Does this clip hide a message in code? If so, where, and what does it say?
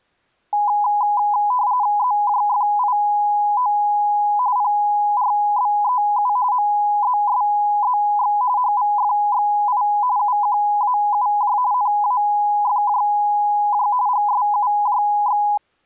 Yes: RTTY (45.45 baud, 170 Hz shift) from 0.5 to 15.6 s, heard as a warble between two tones, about 910 Hz centre. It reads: ZJFIO PRBEU MZSZX HVFXI UQAUJ NAFJJ GSUJX